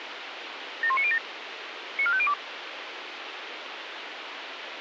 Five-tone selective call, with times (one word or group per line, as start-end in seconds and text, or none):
0.8-1.2 71907
2.0-2.3 94502